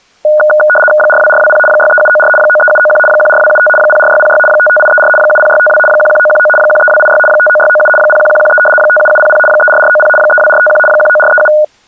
RTTY (75 baud, 850 Hz shift), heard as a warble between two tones, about 1030 Hz centre. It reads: 42420 63794 93791 14275 04606 55834 70652 11919 13286 59697 01113 57700 34490 32451 19437